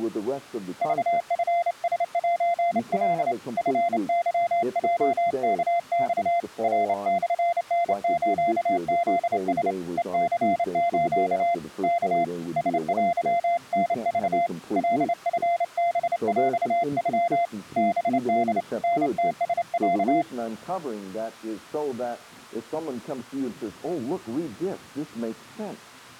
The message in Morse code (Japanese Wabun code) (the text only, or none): クチラセカ チケヲワマ ナモタスフラ ヘニス ワ ラテタク カチハヰノ ハホ タムラロ